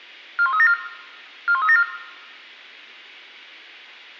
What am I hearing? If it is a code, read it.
Five-tone selective call (ZVEI), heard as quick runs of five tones, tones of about 70 ms, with room echo. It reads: 41374 41374